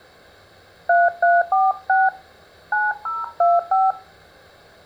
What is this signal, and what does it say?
DTMF, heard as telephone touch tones, dialled by hand, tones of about 190 ms, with room echo. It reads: 3346 9025